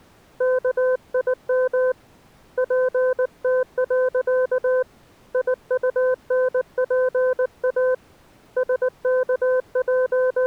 Morse code, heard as a keyed tone, hand-sent with a paddle, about 19 wpm, 510 Hz. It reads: KIM PT. IUNPA …